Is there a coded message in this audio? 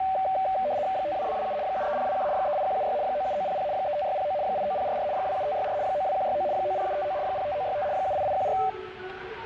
Yes: RTTY (75 baud, 170 Hz shift) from 0.0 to 8.7 s, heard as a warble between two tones, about 680 Hz centre, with the noise of a subway station. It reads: 52227 73021 38176 97900 35609 89044 27564 92169 90759 05965 78814